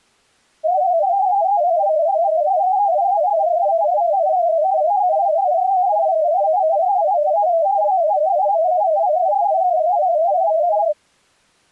Multi-tone FSK (Olivia or MFSK type), about 250 Hz wide, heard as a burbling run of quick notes, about 31.25 baud.